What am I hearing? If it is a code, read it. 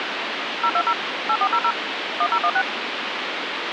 DTMF, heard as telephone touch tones, dialled by machine, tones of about 60 ms, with phone line noise. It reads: 020 8400 1016